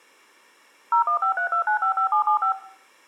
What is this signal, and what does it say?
DTMF, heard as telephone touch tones, dialled by machine, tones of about 100 ms, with room echo. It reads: 01532955775